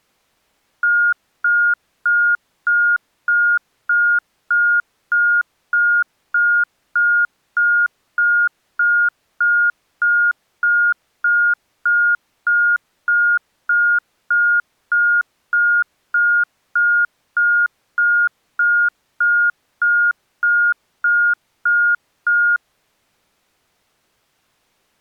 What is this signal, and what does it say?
Evenly repeated beeps. There is no code.